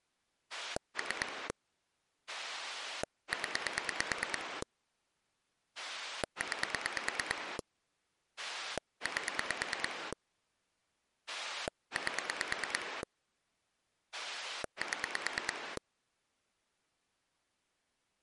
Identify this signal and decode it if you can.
Pulse dialling, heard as a rotary dial, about 9 pulses a second. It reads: 3 0 9 8 8 7